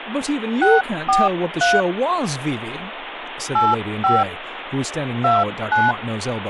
DTMF, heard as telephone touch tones, dialled by hand, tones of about 200 ms, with phone line noise and speech in English. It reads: 643 85 29